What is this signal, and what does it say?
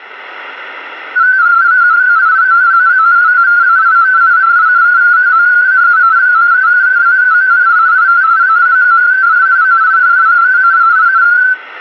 Multi-tone FSK (Olivia or MFSK type), about 250 Hz wide, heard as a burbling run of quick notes, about 31.25 baud.